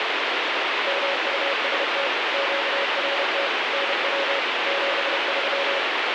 Morse code, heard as a keyed tone, machine-sent, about 31 wpm, 560 Hz, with heavy radio static. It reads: MUST QRT NW 73